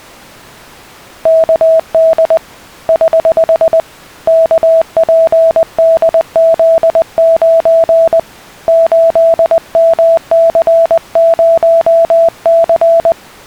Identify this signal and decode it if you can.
Morse code, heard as a keyed tone, hand-sent with a paddle, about 20 wpm, 660 Hz. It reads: KD <HH> KPDZ9 8MC0C